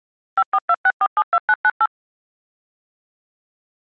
DTMF, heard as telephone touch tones, dialled by machine, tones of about 50 ms. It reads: 5426472998